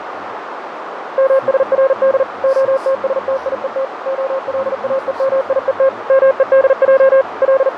Morse code (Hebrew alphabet), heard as a keyed tone, machine-sent, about 40 wpm, 540 Hz, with radio static, fading and a narrow filter. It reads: משרד התשתיות הלאומיות מודע …